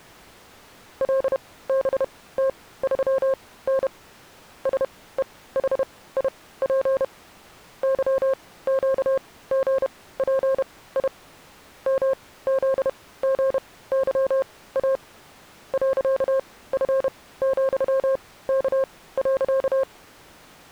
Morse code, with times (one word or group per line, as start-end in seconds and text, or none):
1.0-3.9 LBT3N
4.7-7.0 SEHIP
7.8-11.1 YQGPI
11.9-15.0 MZGYA
15.7-19.8 .F,K.